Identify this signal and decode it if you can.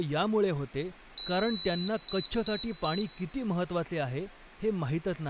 Beep code, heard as a piezo beeper, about 3950 Hz, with room echo and speech in Marathi. 1 long, 3 short. In Award and IBM BIOS tables: video adapter failure; in AMI BIOS tables: memory failure.